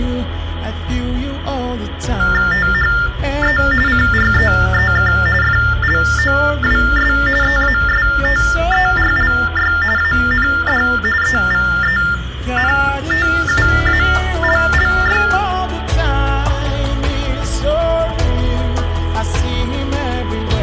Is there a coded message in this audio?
Yes: TTY/TDD text telephone tones (45.45 baud Baudot) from 2.2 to 15.4 s, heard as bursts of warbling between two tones, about 400 Hz shift, 1600 Hz centre, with phone line noise and room echo. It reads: THE CREEK FLOWS EASTERLY AND EVENTUALLY